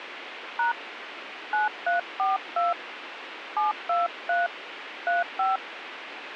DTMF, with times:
0.6-0.7 #
1.5-2.7 9342
3.6-4.5 723
5.1-5.6 35

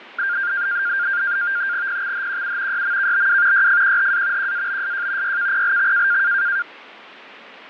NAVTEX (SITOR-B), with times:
1.9-2.8 PXHQU
2.7-3.7 YMKBW
3.5-4.5 YFQHA
4.4-5.4 QABSJ
5.2-6.2 YKPLX

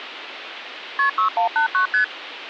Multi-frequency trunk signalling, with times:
1.0-1.1 KP
1.2-1.9 6189
1.9-2.0 ST

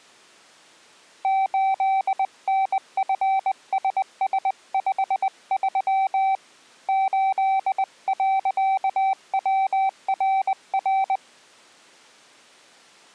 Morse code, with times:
1.2-6.3 8NFSS53
6.9-11.2 8.WRR

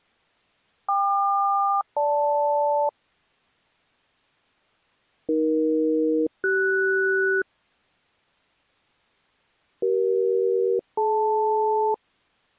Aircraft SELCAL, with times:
0.9-2.9 KQ-GL
5.3-7.4 AE-CS
9.8-11.9 CE-DL

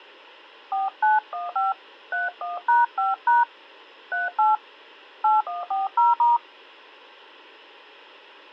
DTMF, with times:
0.7-1.7 4915
2.1-3.4 31#5#
4.1-4.6 38
5.2-6.4 8140*

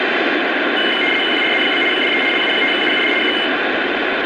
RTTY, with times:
1.3-1.8 QRZ?
1.9-2.2 DE
2.3-3.1 LU5UUD
3.2-3.3 K

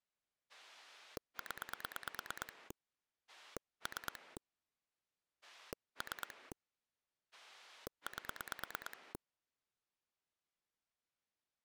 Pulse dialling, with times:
0.5-2.7 0
3.3-4.4 3
5.4-6.5 3
7.3-9.1 8

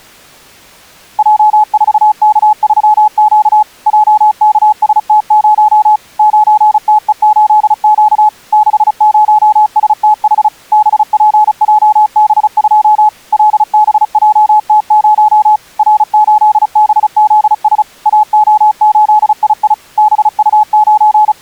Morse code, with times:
1.2-3.6 J4K3Q
3.9-6.0 JKST0
6.2-8.3 9TE8Q
8.5-10.5 60STH
10.7-13.1 BPJB2
13.3-15.6 LBJT0
15.8-17.8 R8BZS
18.1-19.7 AO8II
20.0-21.4 …

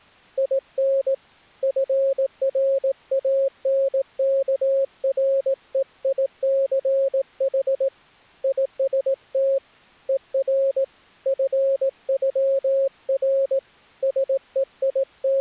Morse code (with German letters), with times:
0.4-1.1 IN
1.6-7.9 FRANKREICH
8.4-9.6 IST
10.1-10.8 ER
11.3-13.6 FÜR
14.0-15.4 …

